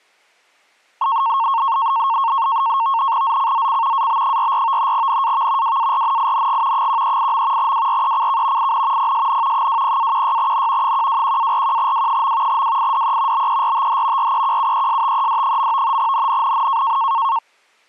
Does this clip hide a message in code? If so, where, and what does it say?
Yes: NAVTEX (SITOR-B), 100 baud, 170 Hz shift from 1.0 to 17.4 s, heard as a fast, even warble, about 1000 Hz centre. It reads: ZCZC AB44 NAV WARNING 138. WRECK IN PSN 20-16N 121-41W. WIDE BERTH REQUESTED. NNNN